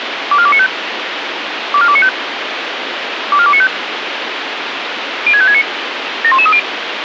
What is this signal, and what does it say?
Five-tone selective call (ZVEI), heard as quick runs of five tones, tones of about 70 ms, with radio hiss. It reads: 24295 24295 24295 06569 71130